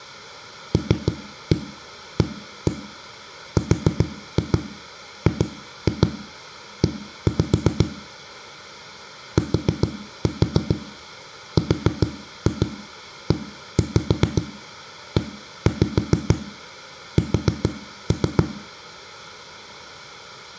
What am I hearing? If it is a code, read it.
Tap code, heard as knocks on a wall, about 7 knocks a second, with room echo. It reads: LARGE TREES